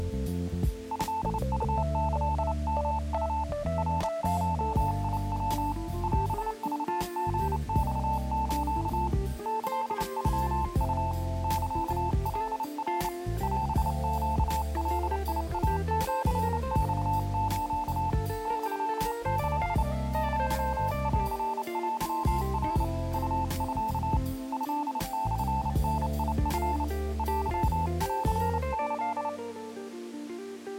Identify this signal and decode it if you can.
Morse code (Japanese Wabun code), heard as a keyed tone, hand-sent with a paddle, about 29 wpm, 880 Hz. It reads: トウキヨウ ナゴヤ オクリマス キノウ サカナ オネガイシマス ユキ アンテナ ウミ トモダチ テンキ